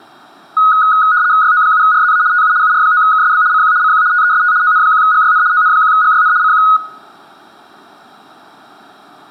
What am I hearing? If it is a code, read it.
RTTY (75 baud, 170 Hz shift), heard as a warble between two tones, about 1360 Hz centre, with room echo. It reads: YO7RZA TU UR9KSB CQ CQ TEST ON1GYN ON1GYN CQ